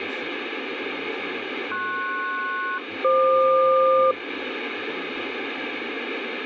Aircraft SELCAL, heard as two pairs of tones, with radio static and speech in Thai. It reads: PS-FQ